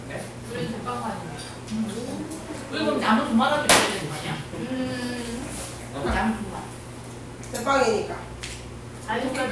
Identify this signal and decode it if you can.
The noise of a crowd indoors. There is no code.